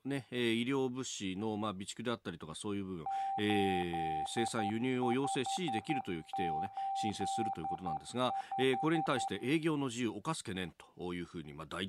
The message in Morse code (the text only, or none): 8585